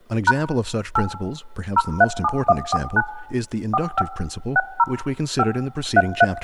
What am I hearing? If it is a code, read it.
DTMF, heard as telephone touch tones, dialled by machine, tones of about 40 ms, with room echo and speech in English. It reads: # 8 037149 45 60 5 33